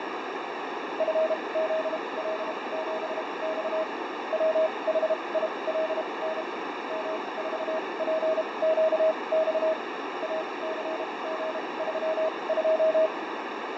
Morse code, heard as a keyed tone, machine-sent, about 32 wpm, spaced as for 24 wpm, 640 Hz, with heavy radio static, fading and a narrow filter. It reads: FZL7X WHILN M4PQX ACG32